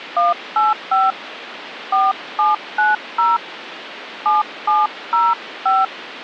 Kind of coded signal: DTMF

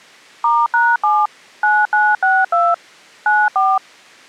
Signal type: DTMF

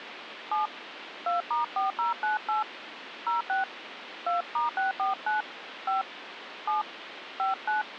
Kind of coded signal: DTMF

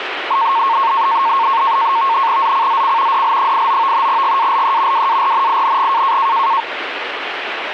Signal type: NAVTEX (SITOR-B)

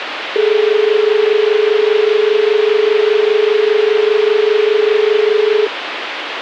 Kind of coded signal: telephone call progress tone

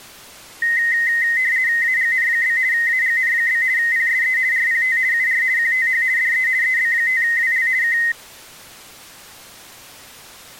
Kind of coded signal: RTTY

